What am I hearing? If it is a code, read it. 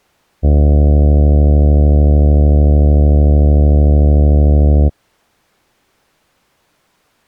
Ship horn signal, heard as a ship's horn, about 70 Hz. 1 long. At sea: a vessel nearing a blind bend, or under power and making way in fog.